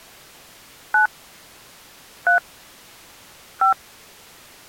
DTMF, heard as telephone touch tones, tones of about 110 ms. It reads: 9 3 5